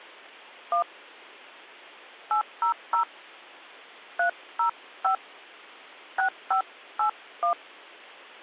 DTMF, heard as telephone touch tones, dialled by hand, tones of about 100 ms. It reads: 1 800 305 6581